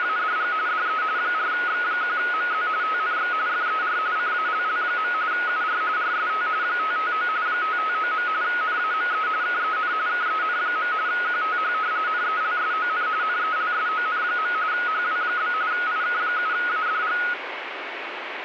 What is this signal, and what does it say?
RTTY (45.45 baud, 170 Hz shift), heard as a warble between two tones, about 1360 Hz centre, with radio static. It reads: … DE 4X1MZ TNX FER CALL. UR RST 559 559. NAME KEN KEN. QTH NELSON NELSON. HW? IK7ADG